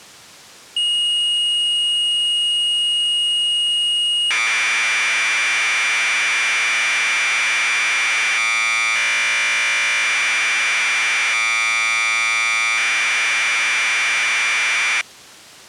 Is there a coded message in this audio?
Yes: Commodore tape loading (standard loader) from 0.8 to 15.0 s, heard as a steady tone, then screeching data.